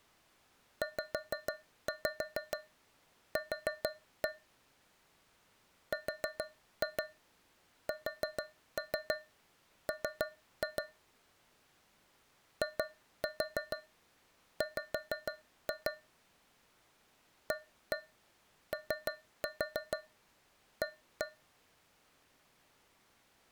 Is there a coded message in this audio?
Yes: tap code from 0.8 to 21.5 s, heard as taps on a metal pipe, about 6 knocks a second. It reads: ZQ RSM IW AOA